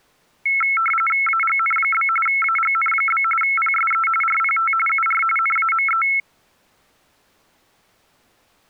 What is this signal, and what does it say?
RTTY (45.45 baud, 850 Hz shift), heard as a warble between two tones, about 1750 Hz centre. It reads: AGN? AGN? PSE RPT UR NAME